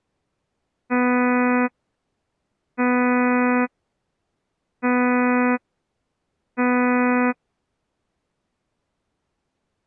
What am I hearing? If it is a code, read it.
Ship horn signal, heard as a ship's horn, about 250 Hz. 4 short. At sea: a pilot vessel's identity signal in fog.